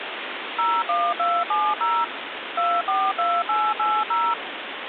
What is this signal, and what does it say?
DTMF, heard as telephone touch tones, dialled by machine, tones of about 240 ms, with phone line noise. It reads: 01270 242880